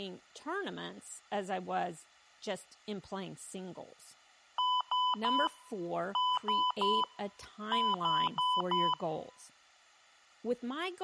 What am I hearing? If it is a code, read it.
Beep code, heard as beeps, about 1000 Hz, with room echo and speech in English. 3-3-4. In Phoenix BIOS tables: video failure.